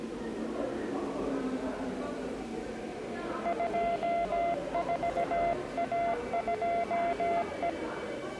Morse code, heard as a keyed tone, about 17 wpm, 690 Hz, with the noise of a subway station. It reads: 24A2E